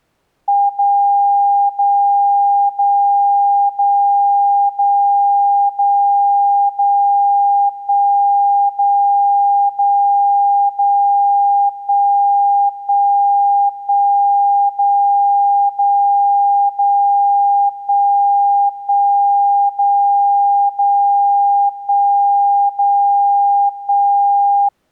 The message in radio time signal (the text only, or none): 0 0 0 0 0 0 0 1 0 0 0 1 1 1 0 0 0 1 1 0 0 1 0 1